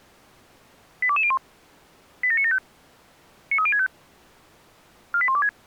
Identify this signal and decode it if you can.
Five-tone selective call (ZVEI), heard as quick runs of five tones, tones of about 70 ms. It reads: 82201 87975 93065 48126